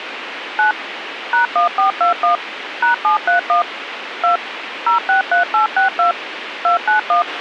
DTMF, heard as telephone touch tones, dialled by machine, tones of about 120 ms, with radio hiss and a squelch burst at the end. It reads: 9 #1421 #731 2 063862 291